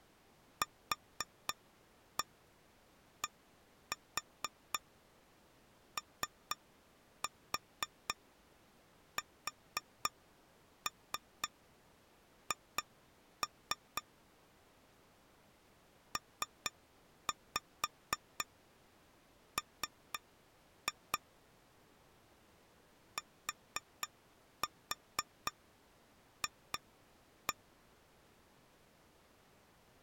Tap code, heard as taps on glass, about 4 knocks a second. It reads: QDOSH PM TF